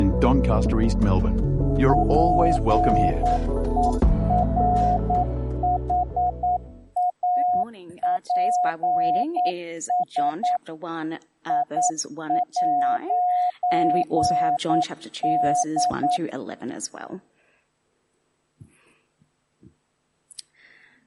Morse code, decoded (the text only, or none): PERHAPS I'D